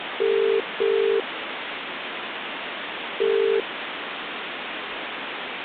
Telephone call progress tone (as in the UK, Ireland, Australia and similar networks), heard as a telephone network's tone, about 400, 450 Hz, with phone line noise. Ringback tone.